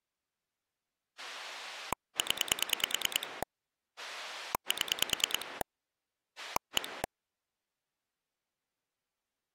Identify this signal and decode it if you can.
Pulse dialling, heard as a rotary dial, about 9 pulses a second. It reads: 0 7 1